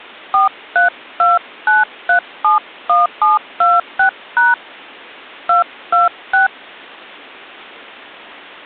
DTMF, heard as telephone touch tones, dialled by hand, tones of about 160 ms. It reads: 4329371726# 226